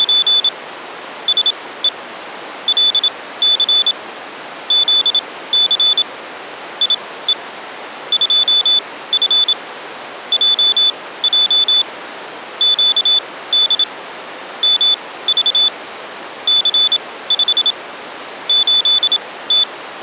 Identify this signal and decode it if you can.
Morse code, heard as a high beeper, machine-sent, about 27 wpm, spaced as for 17 wpm, 3500 Hz. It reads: … SE LC ZC IE 2F JJ QD MV C5 8T